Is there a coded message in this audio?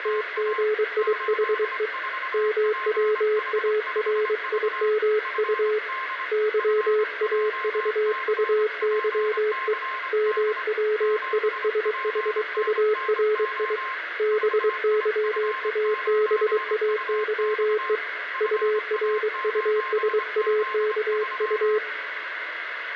Yes: Morse code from 0.0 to 21.8 s, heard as a keyed tone, hand-sent with a bug key, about 23 wpm, 430 Hz, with radio static, a weaker station near 1060 Hz and room echo. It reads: … MWARIMU YAVUYE MWISHURI BYABAYE URUSAKU